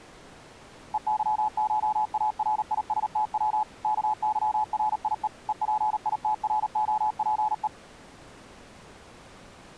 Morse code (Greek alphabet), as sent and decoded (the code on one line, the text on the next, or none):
. -.-- ---- .- .-. .. ... - .-- / -.- -.-- .-. .. . / . .--. .. - .-. --- .--. .
ΕΥΧΑΡΙΣΤΩ ΚΥΡΙΕ ΕΠΙΤΡΟΠΕ